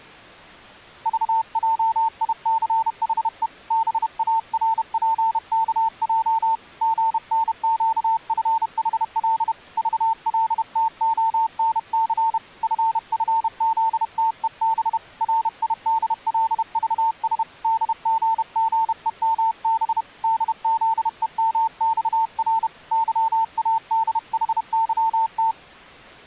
Morse code, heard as a keyed tone, hand-sent with a paddle, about 31 wpm, 900 Hz. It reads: VJICHE BARPKJ GNQFHL VLTONC FFZTEB RIDLVS DGGEMB DZEMXR YADHYT